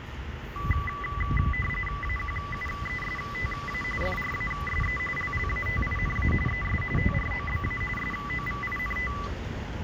RTTY (45.45 baud, 850 Hz shift), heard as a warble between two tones, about 1600 Hz centre, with radio static and the noise of a residential street. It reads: AQUESTA FRASE LLATINA ES TROBA SOVINT